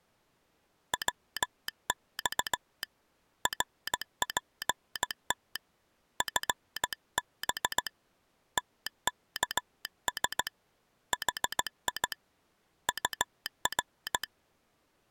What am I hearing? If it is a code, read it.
Morse code, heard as a telegraph sounder, hand-sent with a straight key, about 16 wpm. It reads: WX RPT FB TKS HI UR